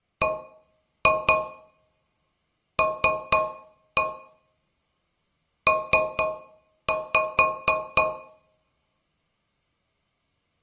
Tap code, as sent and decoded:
1-2 3-1 3-5
BLP

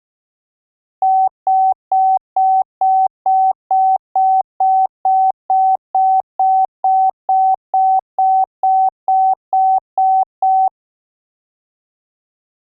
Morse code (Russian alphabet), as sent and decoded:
none

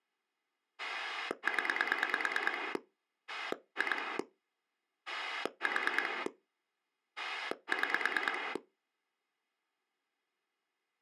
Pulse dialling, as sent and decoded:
10 / 2 / 4 / 6
0 2 4 6

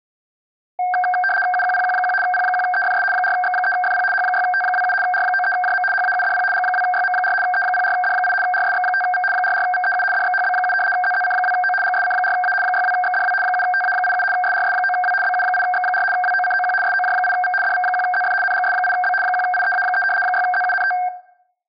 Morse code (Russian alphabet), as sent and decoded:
none

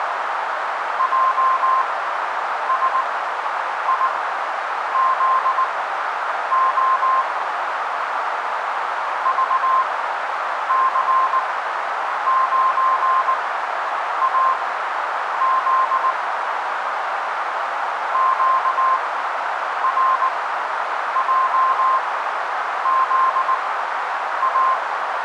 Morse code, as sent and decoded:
.--- ... .. --.. --- / ...- -.-. ----. .- --.. / --.- .-. .--- --.. .-
JSIZO VC9AZ QRJZA

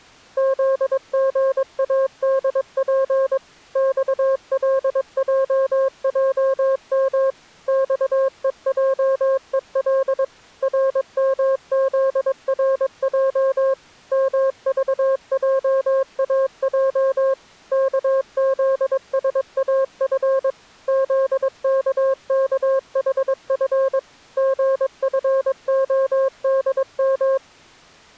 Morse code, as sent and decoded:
--.. --. .- -.. .--. / -..- .-.. .--- .--- -- / -..- . .--- . .-.. / .-. -- --.. .-. .--- / -- ...- .--- .- .--- / -.- --.. ... .- ..-. / --.. -.- -.- .... ..-. / --. ..-. --- -.. --
ZGADP XLJJM XEJEL RMZRJ MVJAJ KZSAF ZKKHF GFODM

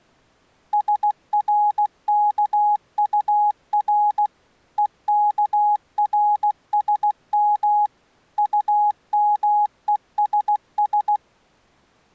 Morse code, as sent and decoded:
... .-. -.- ..- .-. / . -.- .-. ... -- / ..- -- . ... ...
SRKUR EKRSM UMESS

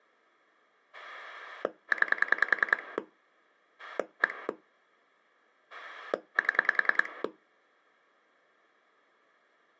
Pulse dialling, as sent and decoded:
9 / 1 / 7
9 1 7

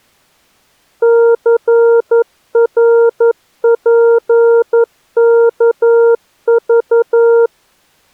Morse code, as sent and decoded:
-.-. .-. .--. -.- ...-
CRPKV

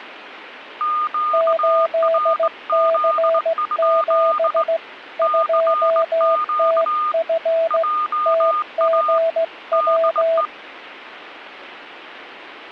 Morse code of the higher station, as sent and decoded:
--.- .-. --.. ..--.. / -.-. --.- / .--- .- / -.. .
QRZ? CQ JA DE

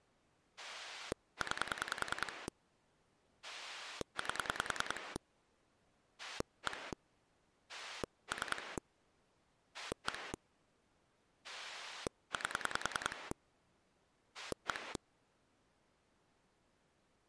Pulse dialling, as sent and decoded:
9 / 8 / 1 / 3 / 1 / 8 / 1
9 8 1 3 1 8 1

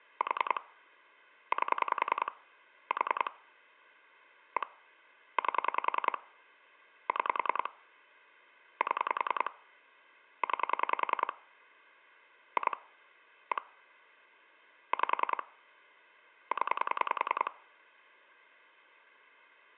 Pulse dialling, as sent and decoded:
4 / 8 / 4 / 1 / 8 / 6 / 7 / 9 / 2 / 1 / 5 / 10
4 8 4 1 8 6 7 9 2 1 5 0

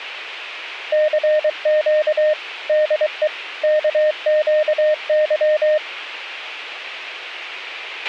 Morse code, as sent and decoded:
-.-. --.- / -.. . / -.- --.- -.--
CQ DE KQY

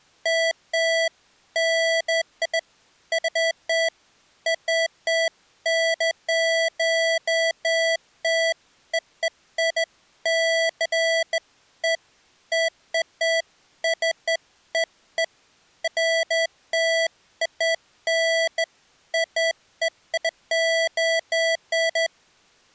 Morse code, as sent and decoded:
none

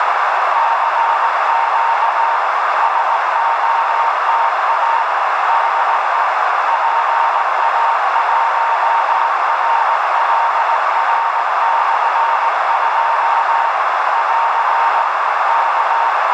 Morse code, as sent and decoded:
-.-. --.- / ... --- - .- / -.. . / .--. .- .---- .-. .-.. .-. -..-. ..--- / .-.-. / -.-
CQ SOTA DE PA1RLR/2 <AR> K

